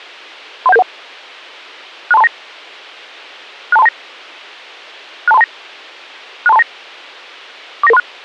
Five-tone selective call (EIA), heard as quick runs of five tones, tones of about 30 ms. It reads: 31771 62329 62329 62329 62329 49936